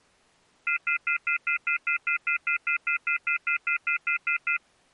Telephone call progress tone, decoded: off-hook warning tone

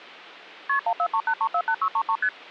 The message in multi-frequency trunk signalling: KP 1438348633 ST

